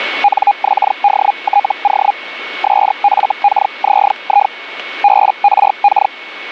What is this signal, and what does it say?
Hellschreiber (Feld-Hell, 122.5 baud), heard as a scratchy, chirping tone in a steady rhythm, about 820 Hz, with radio static and a steady whistle near 2210 Hz. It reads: NXDTO SFKZI BRK